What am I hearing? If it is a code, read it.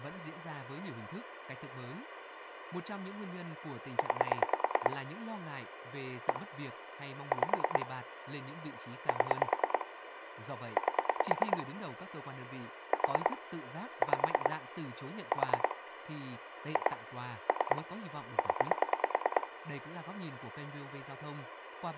Pulse dialling, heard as clicks on a phone line, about 9 pulses a second, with phone line noise and speech in Vietnamese. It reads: 9 1 5 7 8 4 5 4 2 3 0